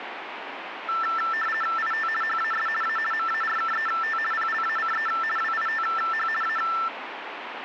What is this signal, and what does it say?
RTTY (50 baud, 450 Hz shift), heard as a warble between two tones, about 1550 Hz centre, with radio static. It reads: IT HAS A MARKET PLACE WITH A